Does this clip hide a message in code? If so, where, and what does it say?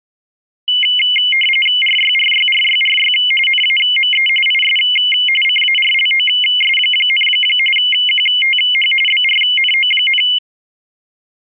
Yes: RTTY (45.45 baud, 850 Hz shift) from 0.7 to 10.4 s, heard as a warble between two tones, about 2550 Hz centre. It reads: RYRYRYRY NAME IS CARLOS, QTH BRNO,